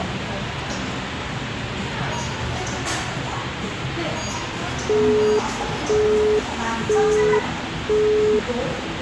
Telephone call progress tone (single-tone plan, as in Europe, Japan and elsewhere), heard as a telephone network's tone, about 420 Hz, 0.5 s on and 0.5 s off, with phone line noise and the noise of a crowd indoors. Busy tone.